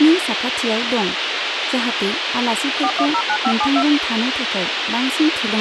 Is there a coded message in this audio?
Yes: DTMF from 2.8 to 3.8 s, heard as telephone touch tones, dialled by machine, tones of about 70 ms, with radio hiss, a squelch burst at the end and speech in Bodo. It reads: 4109572